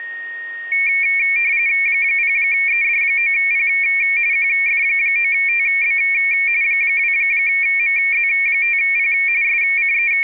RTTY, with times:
1.9-3.7 0ED9P
4.3-6.0 QF9TB
6.6-9.1 2MZ5P
9.4-10.2 …

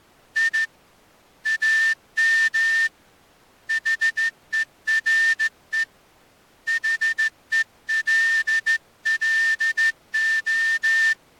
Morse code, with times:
0.4-0.6 I
1.5-2.9 AM
3.7-5.8 HERE
6.7-11.1 HELLO

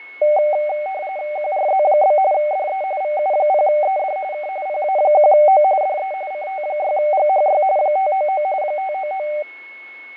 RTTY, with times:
1.4-2.2 QRZ?
2.3-2.8 DE
3.0-4.2 VU0ED
4.3-4.5 K
4.7-5.6 PA1O
5.8-6.1 DE
6.3-7.6 CT6GHY
7.8-8.4 599
8.6-9.3 599

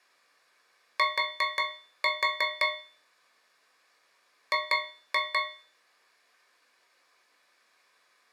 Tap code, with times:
1.0-2.7 T
4.5-5.4 G

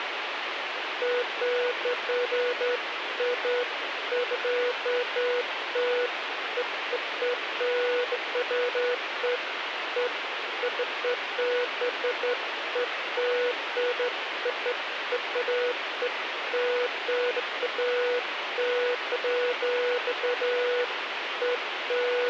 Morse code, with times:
none

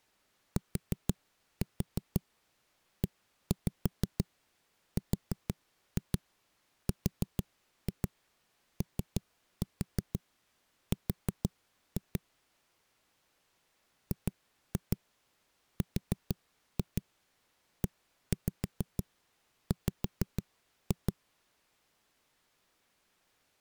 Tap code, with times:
0.6-12.2 TERROR
14.1-21.1 GREW

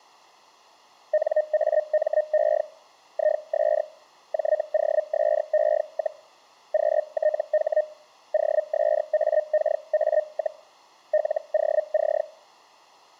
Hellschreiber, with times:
1.1-2.6 NAME
3.1-3.8 IS
4.3-6.2 JOSE,
6.7-7.8 QTH
8.3-10.6 OSAKA,
11.1-12.2 LOC

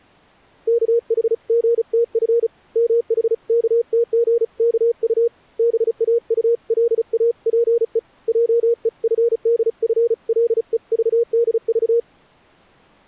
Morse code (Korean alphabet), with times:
0.7-2.5 우선
2.8-5.3 무엇이
5.6-8.0 되고자
8.3-12.0 하는가를

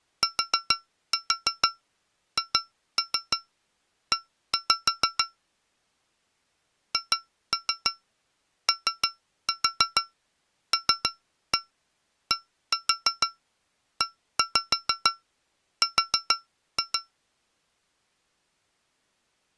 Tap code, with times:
0.2-5.2 THE
6.9-17.0 HOLDER

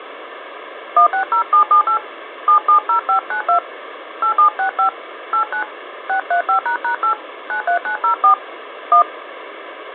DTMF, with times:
1.0-2.0 160778
2.5-3.6 770592
4.2-4.9 8765
5.3-5.6 89
6.1-7.1 635##8
7.5-8.3 93904
8.9-9.0 1

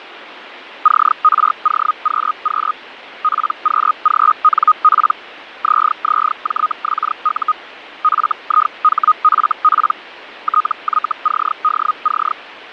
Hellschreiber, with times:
0.8-2.7 CROQQ
3.2-5.1 PQGNP
5.6-7.5 ZZJXU
8.0-9.9 FIHFP
10.4-12.3 TYCDC

